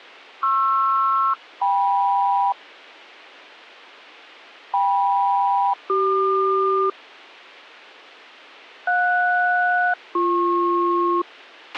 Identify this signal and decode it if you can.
Aircraft SELCAL, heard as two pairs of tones, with a squelch burst at the end. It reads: PR-KM KM-CQ JS-BP